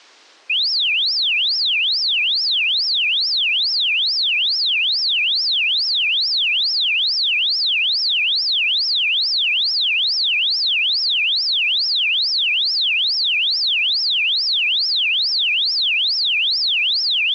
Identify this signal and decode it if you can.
A tone that sweeps in pitch again and again. There is no code.